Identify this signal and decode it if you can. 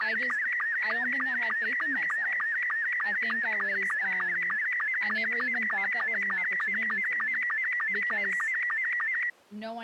SSTV (slow-scan television), Robot 72, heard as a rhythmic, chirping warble, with speech in English.